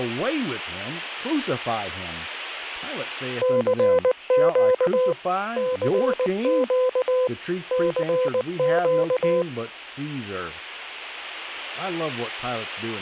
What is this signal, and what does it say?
Morse code, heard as a keyed tone, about 19 wpm, 510 Hz, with speech in English. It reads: CQ CQ CQ